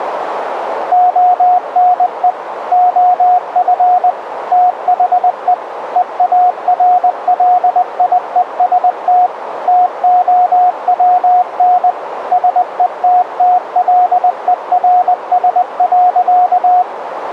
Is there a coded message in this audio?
Yes: Morse code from 0.9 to 16.9 s, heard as a keyed tone, machine-sent, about 20 wpm, 720 Hz, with radio static and a narrow filter. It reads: ONE OF THE EARLIEST TOWN SETTLERS.